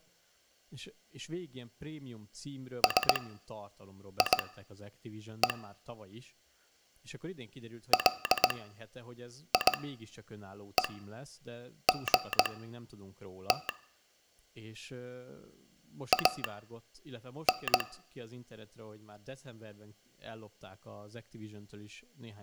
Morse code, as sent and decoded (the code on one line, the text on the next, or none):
... .. . / .-.. .. . --. - / .- -.
SIE LIEGT AN